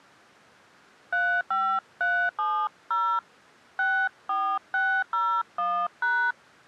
DTMF, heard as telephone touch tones, dialled by hand, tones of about 280 ms. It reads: 35370 64601#